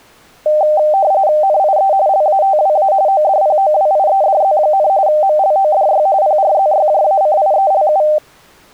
RTTY (45.45 baud, 170 Hz shift), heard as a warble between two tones, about 690 Hz centre. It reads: NIE LATWA ODPOWIEDZ, MLODY PRZYJACIELU